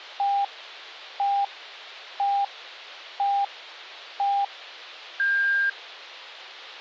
Radio time signal (five pips and a higher one, as on Chinese radio), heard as pips.